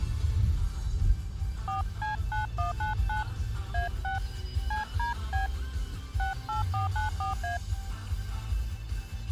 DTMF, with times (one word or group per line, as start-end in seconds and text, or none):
1.7-3.2 4C9199
3.7-4.2 A6
4.7-5.5 CDB
6.2-7.6 68494A